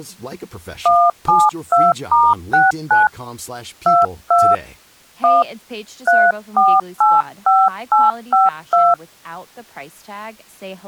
DTMF, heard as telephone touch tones, dialled by hand, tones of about 200 ms, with speech in Persian. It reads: 172*69 22 1 3485852